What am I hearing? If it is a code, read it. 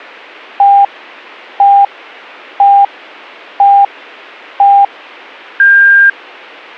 Radio time signal (five pips and a higher one, as on Chinese radio), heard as pips.